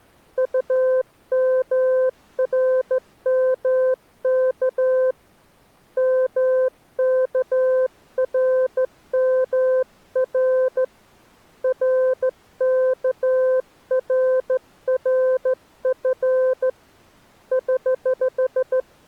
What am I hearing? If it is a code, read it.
Morse code, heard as a keyed tone, hand-sent with a straight key, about 14 wpm, 520 Hz. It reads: UMRMK MKRMR RKRRF <HH>